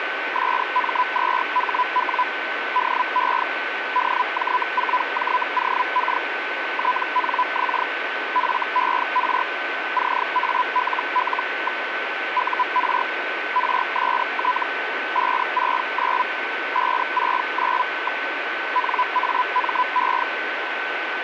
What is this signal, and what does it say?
Hellschreiber (Feld-Hell, 122.5 baud), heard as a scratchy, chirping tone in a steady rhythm, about 1000 Hz, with radio static and a steady whistle near 1520 Hz. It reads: SM2HW DE DJ4JOK TNX FER CALL. UR RST 569 569. NAME